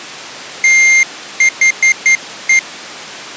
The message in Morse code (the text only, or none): THE